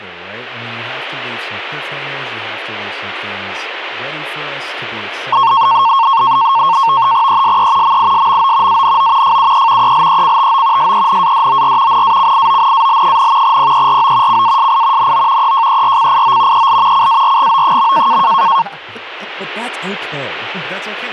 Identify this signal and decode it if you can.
NAVTEX (SITOR-B), 100 baud, 170 Hz shift, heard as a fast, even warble, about 1000 Hz centre, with speech in English. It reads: ESE MISMO ANO FUE ELECTO SENADOR NACIONAL, PERO CASI NO EJERCIO EL CARGO.